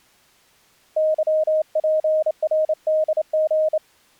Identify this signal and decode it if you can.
Morse code, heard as a keyed tone, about 28 wpm, 620 Hz. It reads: YPRDG